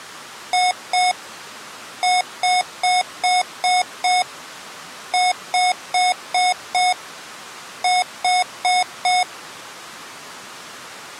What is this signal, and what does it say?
Beep code, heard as beeps from a small speaker, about 730 Hz. 2-6-5-4.